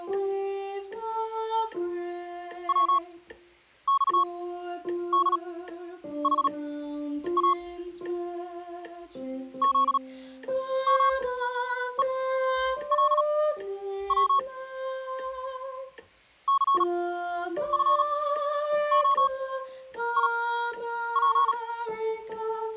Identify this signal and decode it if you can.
Morse code, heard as a keyed tone, machine-sent, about 37 wpm, spaced as for 9 wpm, 1100 Hz. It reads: WXDHA ZMELW CFOIP